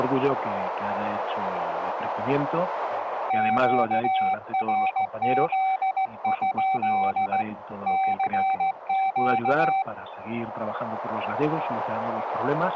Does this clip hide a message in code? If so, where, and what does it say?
Yes: Morse code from 3.2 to 9.9 s, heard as a keyed tone, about 16 wpm, 770 Hz, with radio static. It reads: QRZ? CQ